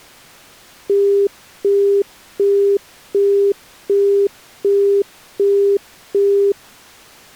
Telephone call progress tone (as in the UK, Australia and similar networks), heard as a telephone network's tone, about 400 Hz, 0.375 s on and 0.375 s off. Busy tone.